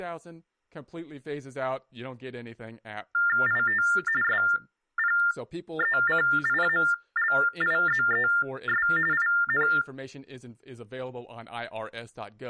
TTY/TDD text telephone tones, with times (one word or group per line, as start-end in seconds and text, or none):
3.5-3.8 IT
4.2-8.9 SPECIALIZES
9.1-9.7 IN